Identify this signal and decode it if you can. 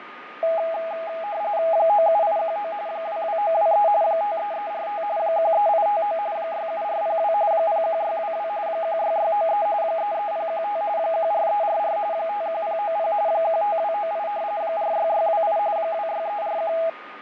RTTY (45.45 baud, 170 Hz shift), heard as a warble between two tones, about 740 Hz centre, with radio static, fading and a steady whistle near 1230 Hz. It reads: 97819 22923 53345 13859 67402 01622 16693 33015 14344 51090 15298 46628 26341